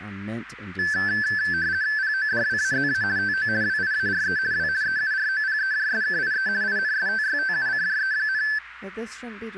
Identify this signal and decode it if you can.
RTTY (50 baud, 170 Hz shift), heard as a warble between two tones, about 1650 Hz centre, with radio static and speech in English. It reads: PODWAZA TO WIARE W EUROPEJSKIE INSTYTUCJE,